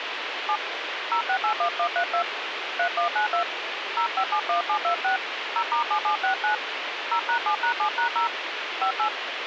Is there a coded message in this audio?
Yes: DTMF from 0.5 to 9.1 s, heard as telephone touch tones, dialled by hand, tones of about 90 ms, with radio hiss. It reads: 7 0681132 3192 0571726 0*7769 0#7#7#0 58